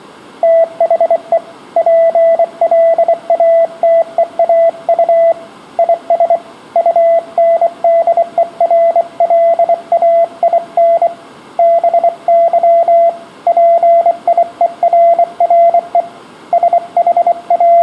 Morse code, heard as a keyed tone, hand-sent with a bug key, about 24 wpm, 670 Hz, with room echo. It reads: THE PLATEAU IS UNDERLAIN BY PIERRE …